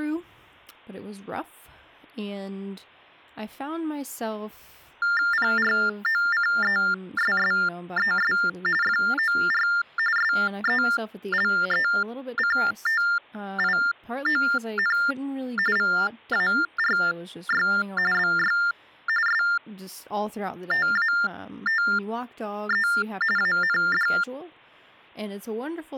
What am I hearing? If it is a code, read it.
TTY/TDD text telephone tones (45.45 baud Baudot), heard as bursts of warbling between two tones, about 400 Hz shift, 1600 Hz centre, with speech in English. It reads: PROCESSES FOR SELECTION VARY BY STATE AND